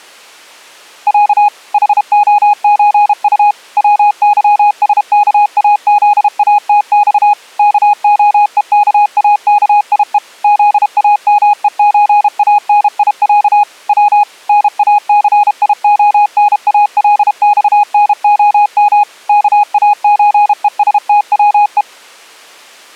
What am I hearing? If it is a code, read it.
Morse code (Russian alphabet), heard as a keyed tone, machine-sent, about 32 wpm, 830 Hz. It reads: Я ХОЧУ ВЫСКАЗАТЬ КОЕКАКИЕ ЗАМЕЧАНИЯ В НАЦИОНАЛЬНОМ КАЧЕСТВЕ